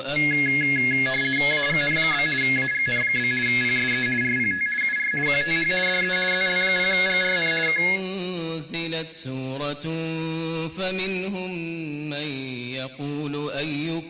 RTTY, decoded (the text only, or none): AGN? AGN? PSE RPT UR QTH DE ZL0GRN K